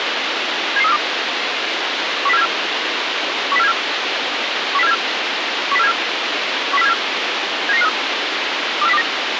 Five-tone selective call (EEA), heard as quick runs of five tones, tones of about 40 ms, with radio hiss. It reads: 77342 10474 10474 10474 10474 10474 79953 24029